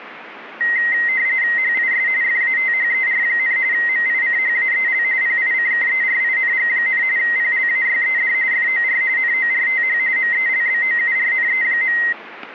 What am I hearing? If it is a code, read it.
RTTY (45.45 baud, 170 Hz shift), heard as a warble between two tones, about 2000 Hz centre. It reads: HIS FATHER, MICHAEL PICKERING, PLAYED FOR NORTH MELBOURNE.